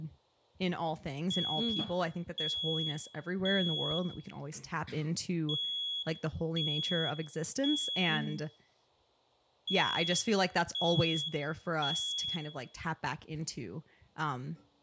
Alarm pattern, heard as an alarm's beeps, played three times, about 3350 Hz, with room echo and speech in English. Temporal three. Smoke or fire, evacuate.